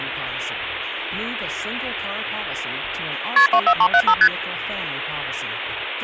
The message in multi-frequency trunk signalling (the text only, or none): KP 24375 ST